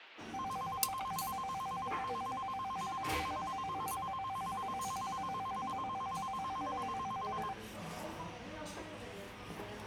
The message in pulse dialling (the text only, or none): none